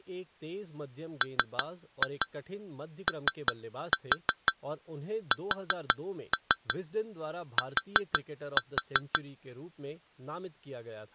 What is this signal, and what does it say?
Tap code, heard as taps on glass, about 5 knocks a second, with speech in Hindi. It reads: MOST